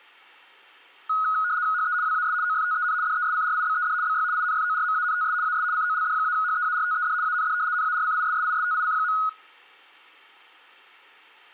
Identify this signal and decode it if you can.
RTTY (75 baud, 170 Hz shift), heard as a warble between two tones, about 1360 Hz centre, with room echo. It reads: HE WAS OFTEN DESCRIBED BY INFORMANTS AS COLD-HEARTED AND NARCISSISTIC.